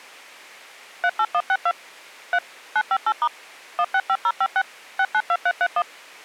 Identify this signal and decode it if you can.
DTMF, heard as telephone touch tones, dialled by machine, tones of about 60 ms. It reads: 38162 3 958* 165056 692331